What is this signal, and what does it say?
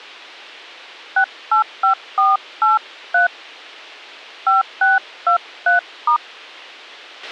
DTMF, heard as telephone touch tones, dialled by hand, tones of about 130 ms, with a squelch burst at the end. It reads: 685483 5623*